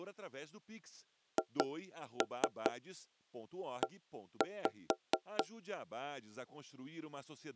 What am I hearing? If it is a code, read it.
Tap code, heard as knocks on wood, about 4 knocks a second, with speech in Portuguese. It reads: HE